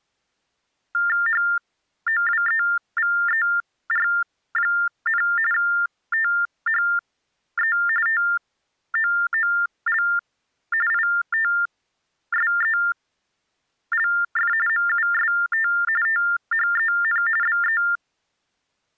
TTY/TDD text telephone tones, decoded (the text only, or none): HOWEVER, THE TOOL ITSELF MUST THEN BE